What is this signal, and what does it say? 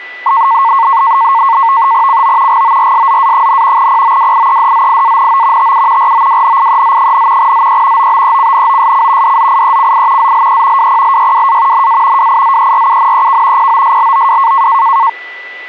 NAVTEX (SITOR-B), 100 baud, 170 Hz shift, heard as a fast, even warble, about 1000 Hz centre, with a steady whistle near 1980 Hz. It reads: CO GORSZA, POWIEDZIANO TU ROWNIEZ, ZE OBECNOSC DZIECI ZLE WPLYWA NA WIZERUNEK POSLOW